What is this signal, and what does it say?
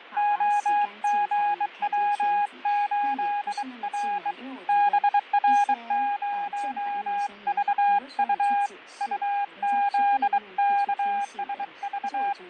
Morse code, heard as a keyed tone, hand-sent with a bug key, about 23 wpm, 820 Hz, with fading. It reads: OGW8R BR0VU UZKSV